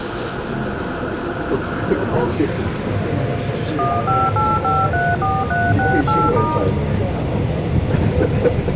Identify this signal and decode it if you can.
DTMF, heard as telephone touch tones, dialled by machine, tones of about 220 ms, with room echo and the noise inside a subway train. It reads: 158534368*